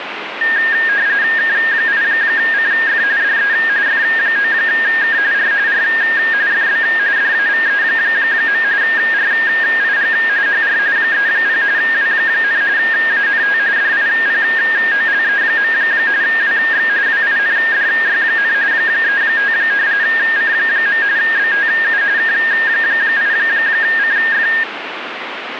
RTTY (45.45 baud, 170 Hz shift), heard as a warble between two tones, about 1750 Hz centre, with radio static. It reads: K8CF DE F9K R R FB DAVE. RIG HR 30 W, ANT DIPOLE. WX WINDY, 35 C. BTU K8CF